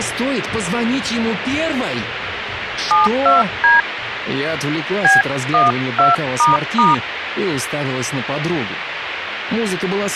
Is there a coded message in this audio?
Yes: DTMF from 2.9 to 6.9 s, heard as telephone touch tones, dialled by hand, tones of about 160 ms, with radio hiss. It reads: 72D B12**